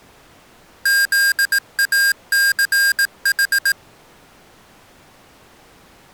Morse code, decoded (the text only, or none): ZACH